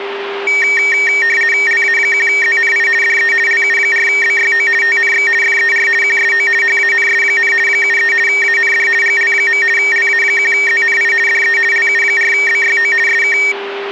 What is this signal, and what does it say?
RTTY (50 baud, 450 Hz shift), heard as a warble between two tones, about 2050 Hz centre, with radio static and a steady whistle near 400 Hz. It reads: LA1ZNI DE LU4BYO TNX FER QSO HANS, 73 AND GL. LA1ZNI DE LU4BYO SK